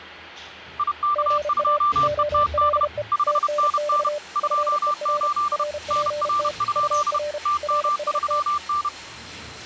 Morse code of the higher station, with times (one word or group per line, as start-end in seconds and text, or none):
0.8-2.8 IK2ETD
3.1-4.1 5NN
4.4-5.6 28
5.9-7.2 NR?
7.5-8.9 TM3N